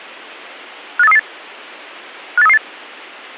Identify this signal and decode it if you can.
Five-tone selective call (EEA), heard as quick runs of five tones, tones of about 40 ms. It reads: 58338 58338